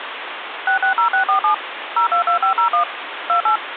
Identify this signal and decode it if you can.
DTMF, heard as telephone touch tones, dialled by machine, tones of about 100 ms, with phone line noise. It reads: 660647 022501 28